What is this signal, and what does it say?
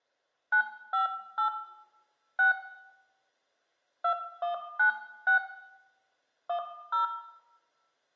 DTMF, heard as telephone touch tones, dialled by hand, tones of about 110 ms, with room echo. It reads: 958 6 2196 10